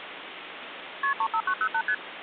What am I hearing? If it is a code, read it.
Multi-frequency trunk signalling (R1, as on North American trunks), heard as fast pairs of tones, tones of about 70 ms, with phone line noise. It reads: KP 35908 ST